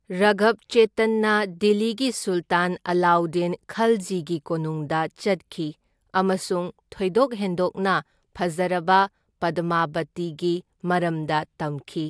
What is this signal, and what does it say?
Speech in Manipuri. There is no code.